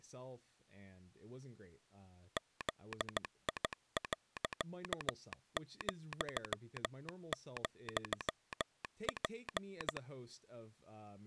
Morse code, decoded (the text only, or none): ZI.,,P